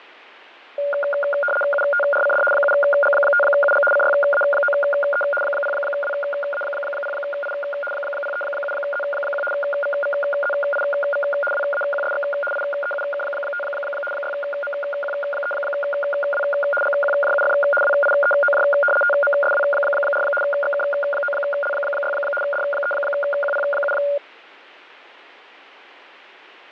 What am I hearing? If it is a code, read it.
RTTY (75 baud, 850 Hz shift), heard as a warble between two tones, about 1000 Hz centre, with radio static and fading. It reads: UTRCD 7G5UG CYA9E 0WA0I 037Z1 VVZIV WAQSX IEUK5 6MQ3W GQJUF WIEOJ TMSW4 XK9L6 D3QP7